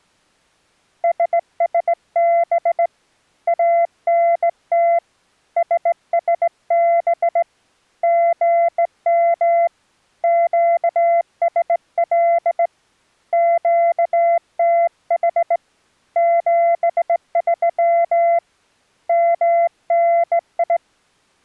Morse code, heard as a keyed tone, hand-sent with a straight key, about 18 wpm, 680 Hz. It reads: SSB ANT SSB GM QSL QTH 73 MNI